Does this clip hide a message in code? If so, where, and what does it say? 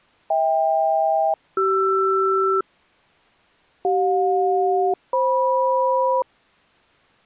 Yes: aircraft SELCAL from 0.3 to 6.2 s, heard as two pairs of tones. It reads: HK-CR CJ-FM